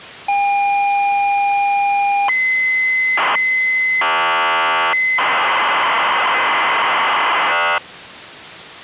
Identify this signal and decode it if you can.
ZX Spectrum tape loading, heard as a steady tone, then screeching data.